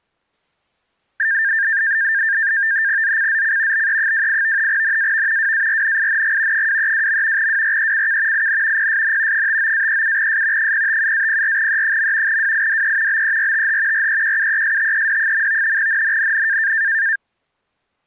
NAVTEX (SITOR-B), 100 baud, 170 Hz shift, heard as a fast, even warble, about 1700 Hz centre. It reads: ZCZC BE28 NAV WARNING 232. WRECK IN PSN 59-37S 057-04E. WIDE BERTH REQUESTED. NNNN